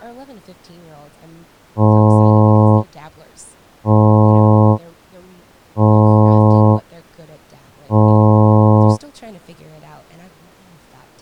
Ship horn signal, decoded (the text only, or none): 4 short